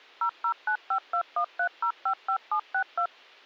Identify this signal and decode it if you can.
DTMF, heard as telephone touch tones, dialled by machine, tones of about 80 ms. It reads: 0095213055762